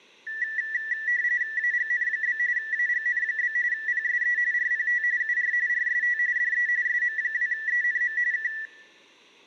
RTTY (45.45 baud, 170 Hz shift), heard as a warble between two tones, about 1850 Hz centre, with room echo. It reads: AGN? AGN? PSE RPT UR RST DE SM2ENM K